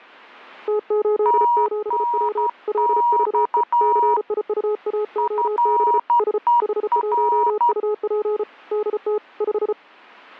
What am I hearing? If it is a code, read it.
Morse code, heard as two keyed tones. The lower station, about 34 wpm, 420 Hz: T87W LVE CIUAOB S H1UP DT 5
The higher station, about 12 wpm, 950 Hz: TNX FER